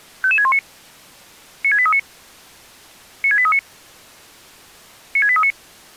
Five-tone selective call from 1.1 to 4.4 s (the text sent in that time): 96839 96839